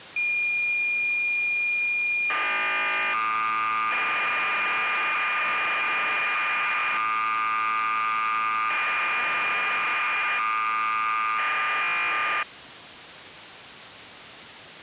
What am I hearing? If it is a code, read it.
Cassette data (Kansas City type), 1200 baud, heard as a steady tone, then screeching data.